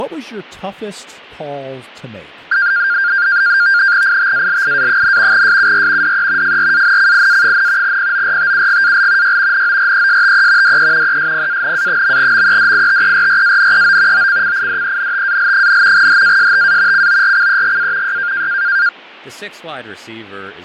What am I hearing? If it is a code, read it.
NAVTEX (SITOR-B), 100 baud, 170 Hz shift, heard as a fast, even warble, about 1500 Hz centre, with fading and speech in English. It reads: ITALIA, SUR DE FRANCIA, PORTUGAL Y NORESTE DE ESPANA.MEDITERRANEO OCCIDENTAL, HASTA CORCEGA Y